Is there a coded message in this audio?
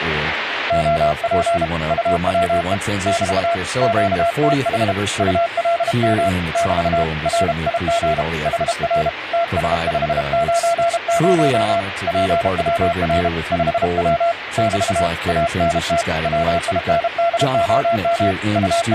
Yes: Morse code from 0.6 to 19.0 s, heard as a keyed tone, hand-sent with a paddle, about 32 wpm, 680 Hz, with radio static and speech in English. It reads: OP UWE <BT> QTH ULM <BT> RIG HR TS590 PWR 5W <BT> ANT WINDOM …